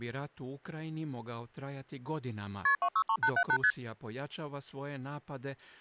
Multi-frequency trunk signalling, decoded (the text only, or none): KP 263878 ST